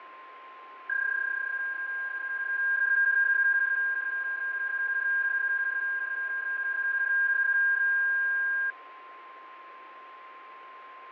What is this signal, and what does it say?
PSK31 (31.25 baud), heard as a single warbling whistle, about 1600 Hz, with fading and a steady whistle near 1050 Hz.